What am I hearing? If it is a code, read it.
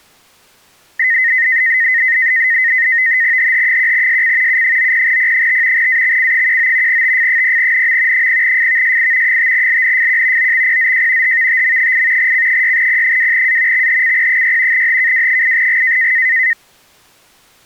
NAVTEX (SITOR-B), 100 baud, 170 Hz shift, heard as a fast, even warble, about 1950 Hz centre. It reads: HH1SC U90P5 AXC19 TF0NM 0FVSI 5LNFQ OXPZJ HVTM8 C6P2A XHCP6 HKW8G